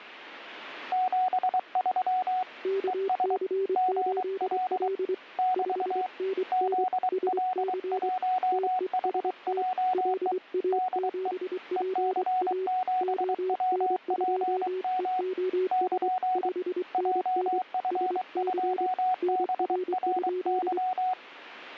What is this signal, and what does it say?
Morse code, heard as two keyed tones. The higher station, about 23 wpm, 740 Hz: 73 ES GL <BT> ZL1HJE DE EC7WPM <KN> JF2BRY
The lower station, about 24 wpm, 380 Hz: KC8L 5NN SC TEST LA7PA ON2EOS 5NN SC NR?